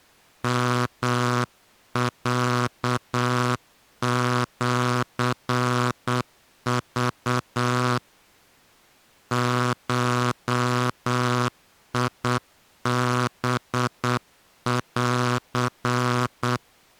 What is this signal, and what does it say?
Morse code (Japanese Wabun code), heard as a buzzer, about 8 wpm. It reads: ヨロシク ゴハン